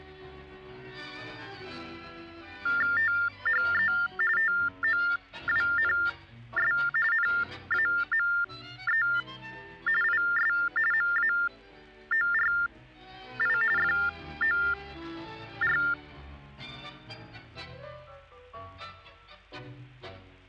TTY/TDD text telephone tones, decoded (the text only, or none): THE TOWNS NAME IS MAORI FOR